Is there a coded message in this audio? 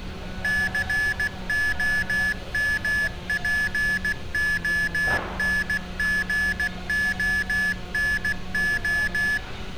Yes: Morse code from 0.4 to 9.4 s, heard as electronic beeps, machine-sent, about 16 wpm, 1700 Hz, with room echo and street noise. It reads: COMPONGONO